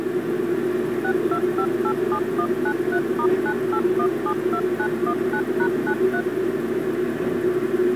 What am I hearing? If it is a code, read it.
DTMF, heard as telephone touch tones, dialled by machine, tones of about 70 ms, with a squelch burst at the end and the noise inside a subway train. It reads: 62587193*98172919#93